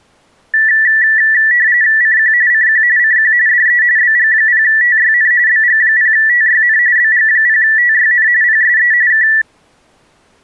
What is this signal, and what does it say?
RTTY (45.45 baud, 170 Hz shift), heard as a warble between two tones, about 1850 Hz centre. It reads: CQ CQ CQ DE BG0TYN BG0TYN BG0TYN PSE K